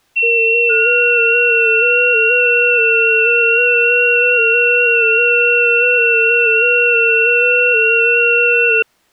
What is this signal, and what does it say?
FT8 (several signals at once), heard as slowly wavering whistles, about 6.25 baud.